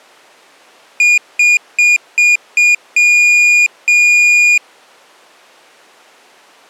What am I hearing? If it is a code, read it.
Beep code, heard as a piezo beeper, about 2450 Hz. 5 short, 2 long.